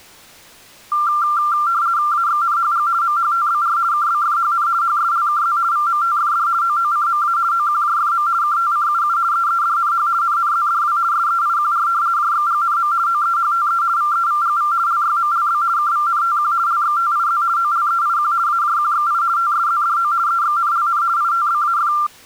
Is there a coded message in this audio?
Yes: RTTY (50 baud, 170 Hz shift) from 0.9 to 22.1 s, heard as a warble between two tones, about 1280 Hz centre. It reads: AXNHG MHTBR KBFHN HSLKZ VMTFD OOCMA OQJFM KTCUU EEDNH NNZDW SEIQR JXGNM OEHTE VEVGV LYMLB KVNTQ LXTIZ OLEIQ AJQXI TSZDO EXNLN ITBAF